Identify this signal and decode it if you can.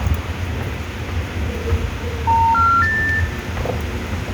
Telephone call progress tone (North American plan), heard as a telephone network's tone, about 910, 1370, 1800 Hz, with phone line noise, room echo and the noise of a subway station. Special information tone.